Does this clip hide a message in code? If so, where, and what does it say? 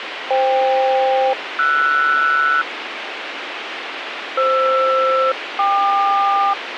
Yes: aircraft SELCAL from 0.3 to 6.5 s, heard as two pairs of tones, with radio hiss. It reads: FK-RS FR-KQ